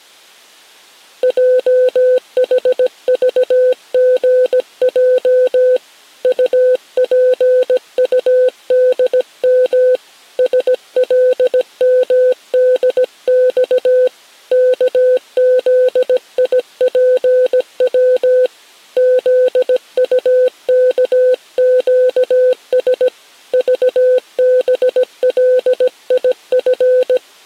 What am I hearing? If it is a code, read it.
Morse code, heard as a keyed tone, hand-sent with a paddle, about 17 wpm, 510 Hz. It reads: JHVGJ UPUDM SLMDX KZIPW ZUKQS VBLIF